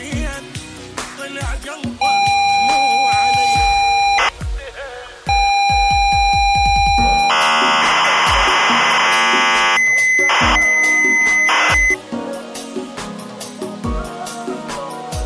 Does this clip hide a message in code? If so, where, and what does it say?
Yes: ZX Spectrum tape loading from 2.0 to 11.9 s, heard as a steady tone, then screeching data.